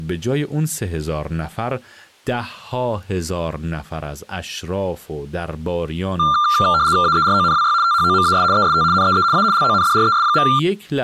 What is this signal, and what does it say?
RTTY (75 baud, 170 Hz shift), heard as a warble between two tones, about 1280 Hz centre, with speech in Persian. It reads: AERONWY THOMAS EST NEE A LONDRES.